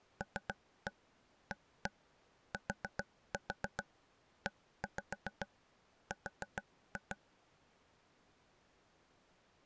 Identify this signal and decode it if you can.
Tap code, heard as taps on a table, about 7 knocks a second. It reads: LATER